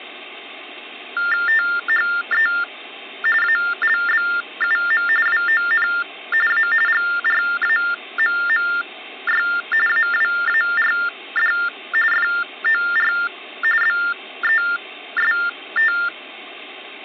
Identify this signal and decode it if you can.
TTY/TDD text telephone tones (45.45 baud Baudot), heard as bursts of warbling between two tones, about 400 Hz shift, 1600 Hz centre. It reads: THE ALBUM WON A GRAMMY AWARD FOR BEST